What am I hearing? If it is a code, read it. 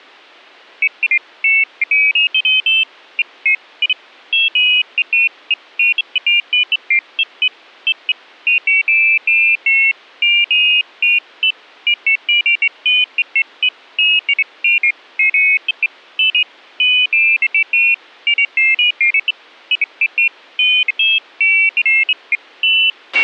Pairs of high tones at irregular times, with a squelch burst at the end. There is no code.